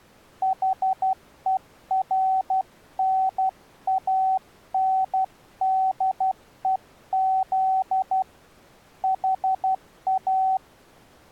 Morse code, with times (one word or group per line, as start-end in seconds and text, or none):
0.4-8.2 HERNANDEZ
9.0-10.6 HA